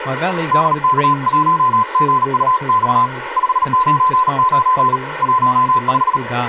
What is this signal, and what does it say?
Morse code, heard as a keyed tone, hand-sent with a paddle, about 38 wpm, 1020 Hz, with radio static and speech in English. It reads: DK1GUX 599 15